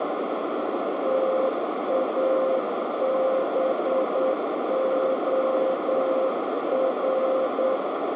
Morse code, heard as a keyed tone, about 8 wpm, 530 Hz, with heavy radio static and a narrow filter. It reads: TABOR